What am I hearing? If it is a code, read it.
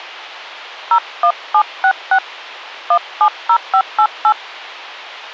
DTMF, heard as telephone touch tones, dialled by hand, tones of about 70 ms. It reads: 01766 170588